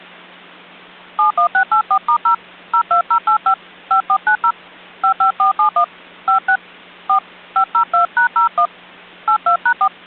DTMF, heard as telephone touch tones, dialled by hand, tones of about 100 ms. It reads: 71684*0 02085 5490 55471 56 4 502#01 82#4